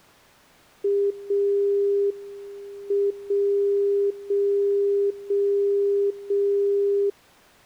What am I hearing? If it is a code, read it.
Radio time signal (WWVB), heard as a tone whose level steps once a second, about 400 Hz. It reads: 0 M 0 0 0 0